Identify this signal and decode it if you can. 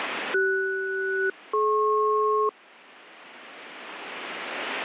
Aircraft SELCAL, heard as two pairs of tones. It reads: CS-DP